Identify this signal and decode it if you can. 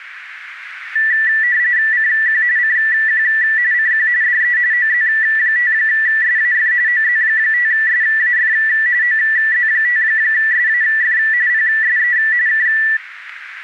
RTTY (45.45 baud, 170 Hz shift), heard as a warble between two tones, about 1850 Hz centre, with radio static. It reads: CQ CQ CQ DE OZ5SAF OZ5SAF OZ5SAF PSE K